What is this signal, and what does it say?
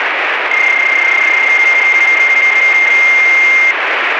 PSK31 (31.25 baud), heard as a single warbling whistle, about 2100 Hz, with radio static.